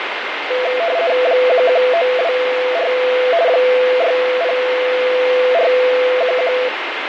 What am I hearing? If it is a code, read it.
RTTY (50 baud, 170 Hz shift), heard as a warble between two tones, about 590 Hz centre, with radio static. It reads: 11924 60411